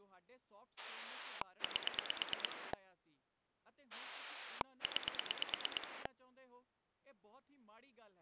Pulse dialling, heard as a rotary dial, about 9 pulses a second, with speech in Punjabi. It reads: 8 9